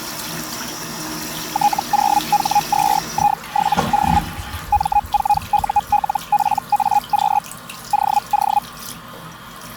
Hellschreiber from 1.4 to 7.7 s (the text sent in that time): T0H2I7O M4ULPAQ